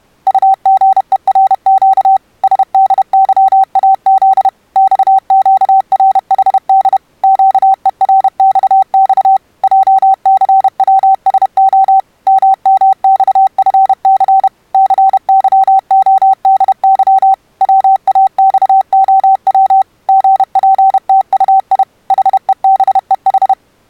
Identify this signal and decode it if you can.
Morse code, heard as a keyed tone, machine-sent, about 31 wpm, 770 Hz. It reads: UGERQ SDYAZ XQRHD QERXX JCWSO MMXFC CYODY WAXOW GPTUI HEBEH